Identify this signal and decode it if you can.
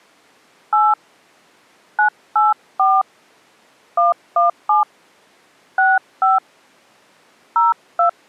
DTMF, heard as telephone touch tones, dialled by hand, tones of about 160 ms. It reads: 8 984 117 65 02